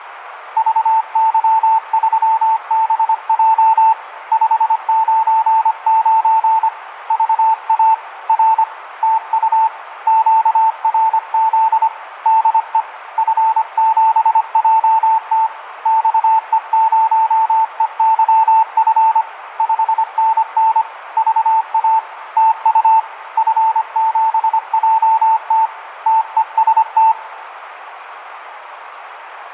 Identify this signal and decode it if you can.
Morse code, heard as a keyed tone, hand-sent with a paddle, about 25 wpm, 890 Hz, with radio static and room echo. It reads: VY3BJ 599 VA R TU QRZ DE F7JT XE0EYF 5NN VA TU F7JT TEST